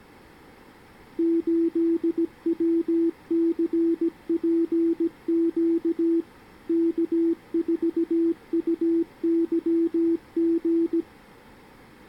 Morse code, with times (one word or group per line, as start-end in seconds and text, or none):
1.2-6.2 8WCPQ
6.7-11.0 K4UYG